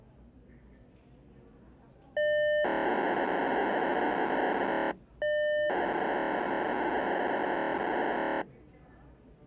POCSAG pager data (1200 baud), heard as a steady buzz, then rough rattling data, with the noise of a crowd indoors.